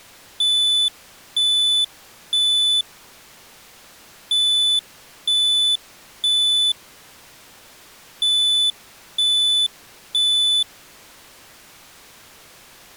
Alarm pattern, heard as an alarm's beeps, played three times, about 3500 Hz. Temporal three. Smoke or fire, evacuate.